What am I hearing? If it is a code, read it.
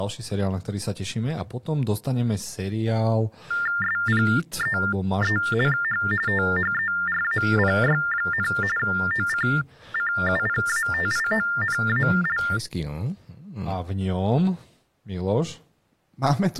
TTY/TDD text telephone tones (45.45 baud Baudot), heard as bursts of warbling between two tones, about 400 Hz shift, 1600 Hz centre, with speech in Slovak. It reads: SPEECH THERAPY, OCCUPATIONAL